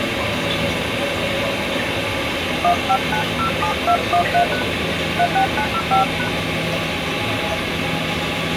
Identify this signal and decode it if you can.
DTMF, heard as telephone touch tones, dialled by hand, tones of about 90 ms, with phone line noise and the noise of a restroom. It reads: 15907213# 36905#